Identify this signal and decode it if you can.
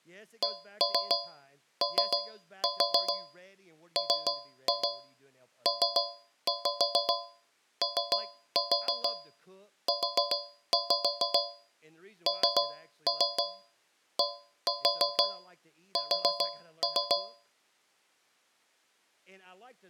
Tap code, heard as taps on a metal pipe, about 6 knocks a second, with speech in English. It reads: COMPOUNDS